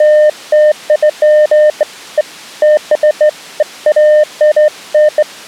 Beeps of irregular length. There is no code.